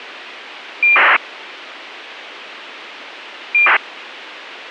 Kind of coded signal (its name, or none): ACARS aircraft data